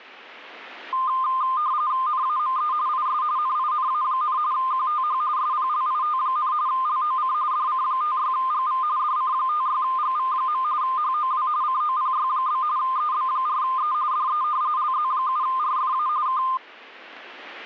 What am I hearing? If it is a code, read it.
RTTY (45.45 baud, 170 Hz shift), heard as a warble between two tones, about 1130 Hz centre. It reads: NAME IS NINA, QTH SPLIT, LOC DC56GV DC56GV. HOW COPY? EB4E DE LZ7RFA K